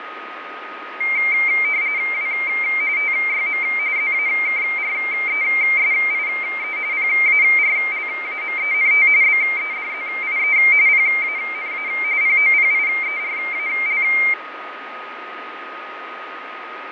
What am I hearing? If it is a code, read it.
RTTY (45.45 baud, 170 Hz shift), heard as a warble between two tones, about 2200 Hz centre, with radio static, fading and a steady whistle near 1250 Hz. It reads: W TYM ZAKRESIE PARLAMENT BEDZIE PANA POPIERAL